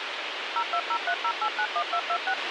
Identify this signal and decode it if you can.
DTMF, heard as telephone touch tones, dialled by machine, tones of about 70 ms, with radio hiss and a squelch burst at the end. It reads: 02030891226